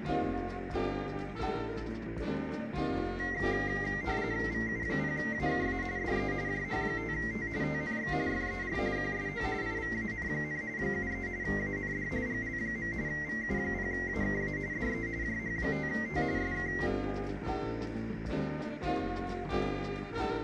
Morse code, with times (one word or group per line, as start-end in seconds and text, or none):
none